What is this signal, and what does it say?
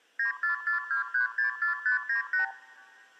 Multi-frequency trunk signalling (R2, with the far end's replies), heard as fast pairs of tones, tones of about 120 ms, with room echo. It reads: 9442364598